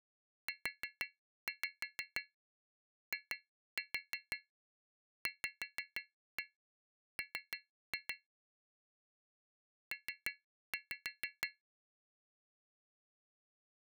Tap code, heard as taps on glass, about 6 knocks a second. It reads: UIVM P